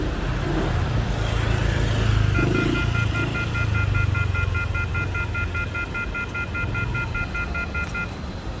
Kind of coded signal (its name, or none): telephone call progress tone